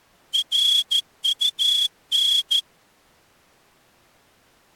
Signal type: Morse code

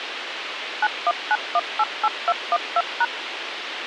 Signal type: DTMF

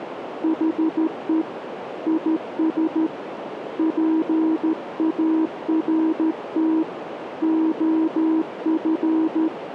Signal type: Morse code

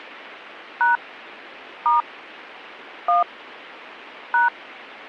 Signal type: DTMF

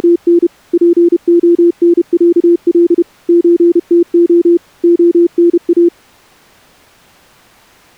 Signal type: Morse code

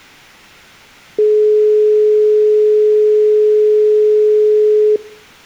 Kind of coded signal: telephone call progress tone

